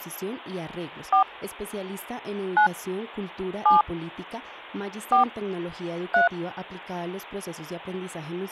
DTMF, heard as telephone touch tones, dialled by hand, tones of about 130 ms. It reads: 4 9 7 4 3